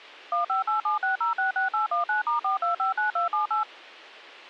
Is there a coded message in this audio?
Yes: DTMF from 0.3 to 3.6 s, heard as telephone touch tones, dialled by machine, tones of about 130 ms. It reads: 15876066819*4259278